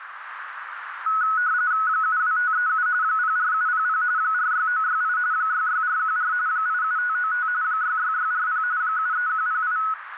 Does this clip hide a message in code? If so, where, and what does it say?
Yes: RTTY (45.45 baud, 170 Hz shift) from 1.1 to 9.9 s, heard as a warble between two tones, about 1380 Hz centre, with radio static and a narrow filter. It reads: 72537 04700 46968 66414 87595 66640 73108